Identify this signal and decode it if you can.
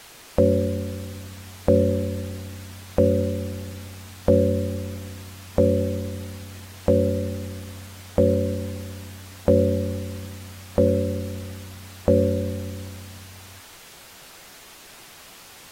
Clock strike, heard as a bell. 10. Ten o'clock.